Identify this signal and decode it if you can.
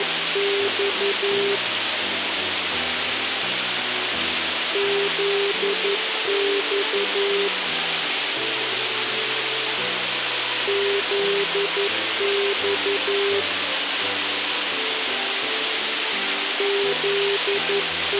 Morse code, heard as a keyed tone, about 11 wpm, 400 Hz, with radio hiss. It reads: … ZX ZX …